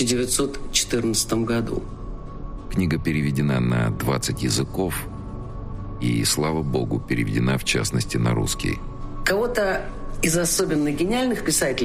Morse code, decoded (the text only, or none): none